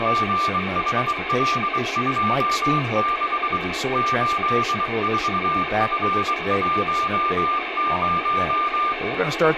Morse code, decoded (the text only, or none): GHL26 84F10